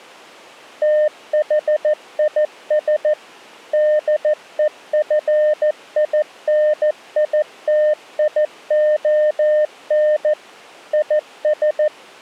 Morse code, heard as a keyed tone, machine-sent, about 14 wpm, 610 Hz. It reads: THIS DEFINITION IS